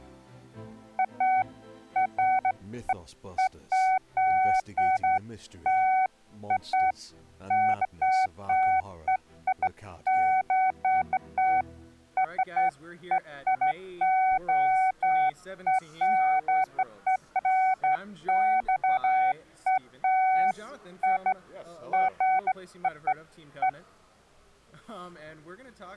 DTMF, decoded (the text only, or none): none